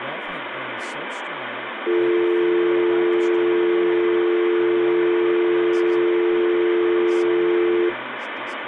Telephone call progress tone (North American or UK plan), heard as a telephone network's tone, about 350, 440 Hz, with phone line noise and speech in English. Dial tone.